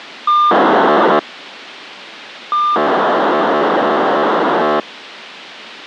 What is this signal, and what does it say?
POCSAG pager data (2400 baud), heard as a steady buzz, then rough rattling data, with radio hiss.